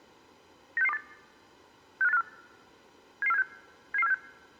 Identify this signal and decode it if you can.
Five-tone selective call (EEA), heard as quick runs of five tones, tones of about 40 ms. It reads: 96628 65854 77476 77476